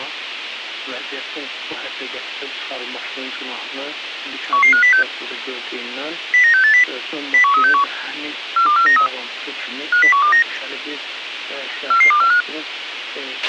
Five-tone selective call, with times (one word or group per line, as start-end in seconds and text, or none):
4.5-5.0 11506
6.3-6.8 09680
7.3-7.8 01361
8.6-9.1 42493
9.9-10.4 50129
11.9-12.4 44245